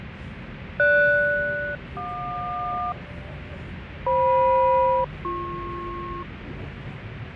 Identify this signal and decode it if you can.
Aircraft SELCAL, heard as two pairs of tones, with radio static, fading and the noise inside a subway train. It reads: GS-JQ FM-BP